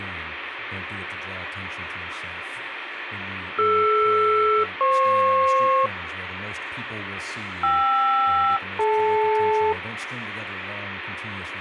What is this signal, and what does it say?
Aircraft SELCAL, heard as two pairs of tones, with radio static. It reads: DR-FP KR-DL